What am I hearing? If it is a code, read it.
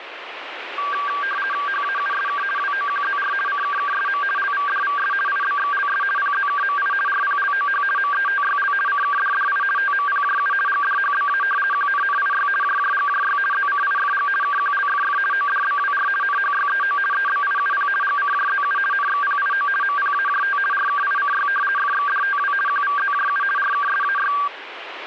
RTTY (50 baud, 450 Hz shift), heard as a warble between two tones, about 1370 Hz centre, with radio static. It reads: HAUSK WOQZR CKKSM LVDVS IBXLS PZKMI RPLOH METYL CKDDI TMPJU GDHBA QNNIY JJGJY ZCIFG KQLFF ODBWR NHYEO EBIUP GCJZU NXPIO MPAJT RKICY FXDTW QVZJU RKSAY